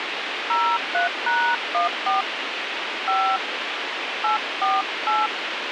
DTMF, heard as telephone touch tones, dialled by hand, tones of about 210 ms, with radio hiss. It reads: 03#14 5 848